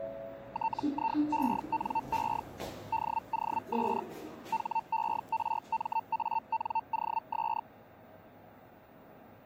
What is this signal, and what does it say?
Hellschreiber (Feld-Hell, 122.5 baud), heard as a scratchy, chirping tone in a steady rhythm, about 900 Hz, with the noise inside a lift. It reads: TIENE DOS HERMANOS